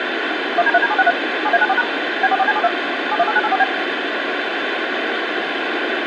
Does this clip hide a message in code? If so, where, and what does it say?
Yes: DTMF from 0.6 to 3.6 s, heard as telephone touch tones, dialled by machine, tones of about 40 ms, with radio hiss. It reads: 1D3D763 7A94# B44C72 718984B